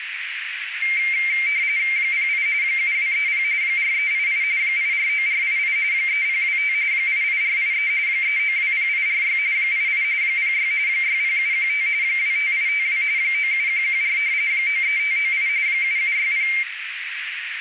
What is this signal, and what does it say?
RTTY (45.45 baud, 170 Hz shift), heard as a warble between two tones, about 2200 Hz centre, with radio static and a narrow filter. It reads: 08 7230 4388 849488 3025 88483 3920846 88 06 60715 25852 97114 93598 7760